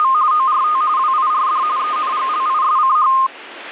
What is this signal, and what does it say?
RTTY (45.45 baud, 170 Hz shift), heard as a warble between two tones, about 1140 Hz centre, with radio static. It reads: … ORT WIRD ENGLISCH